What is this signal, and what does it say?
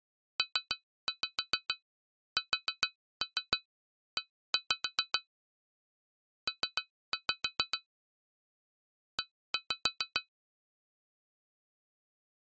Tap code, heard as taps on glass, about 7 knocks a second. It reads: PSE P E